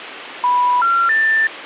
Telephone call progress tone (North American plan), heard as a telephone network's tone, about 980, 1370, 1800 Hz, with phone line noise. Special information tone.